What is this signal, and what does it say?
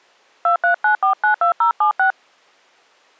DTMF, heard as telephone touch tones, dialled by hand, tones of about 110 ms. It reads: 239492076